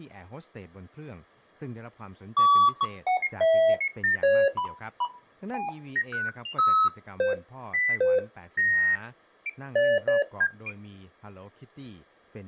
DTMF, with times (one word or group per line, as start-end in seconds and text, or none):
none